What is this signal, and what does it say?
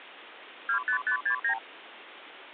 Multi-frequency trunk signalling (R2, with the far end's replies), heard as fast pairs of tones, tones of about 90 ms, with phone line noise. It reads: 25569